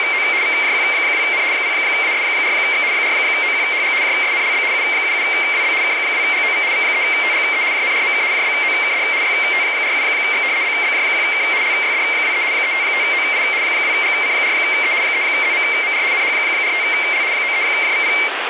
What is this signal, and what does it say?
RTTY (75 baud, 170 Hz shift), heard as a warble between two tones, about 2200 Hz centre, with radio static. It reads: … VJQ2N 0AS4X 4OQHG JSNLB U77WB K2GOV V3TGE JNRMK JBOKD YT47X BBJ1K LYD23 355OI 2GC4E 3ZMMR NH45L 93JVP